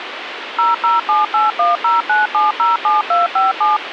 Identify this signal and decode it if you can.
DTMF, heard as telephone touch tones, dialled by machine, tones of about 160 ms, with radio hiss. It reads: 0078109707257